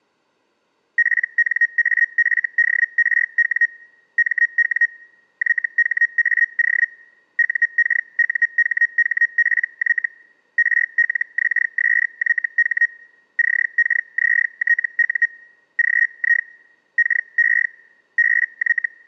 Hellschreiber (Feld-Hell, 122.5 baud), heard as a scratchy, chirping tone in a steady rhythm, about 1900 Hz. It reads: PNAFDRW MW YHAO UKUHHPY RLXSYH CKZTU GI KE BY